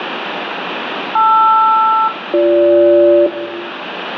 Aircraft SELCAL, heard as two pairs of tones, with radio static and room echo. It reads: LR-BG